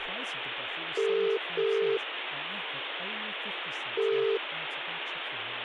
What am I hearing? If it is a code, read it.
Telephone call progress tone (as in the UK, Ireland, Australia and similar networks), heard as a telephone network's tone, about 400, 450 Hz, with phone line noise and speech in English. Ringback tone.